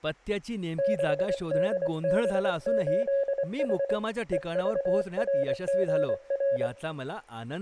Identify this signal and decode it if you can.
Morse code, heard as a keyed tone, hand-sent with a paddle, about 24 wpm, 550 Hz, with room echo and speech in Marathi. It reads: 6DB8H EVRGR